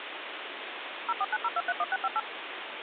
DTMF, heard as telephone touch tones, dialled by machine, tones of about 40 ms, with phone line noise. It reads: 0490231658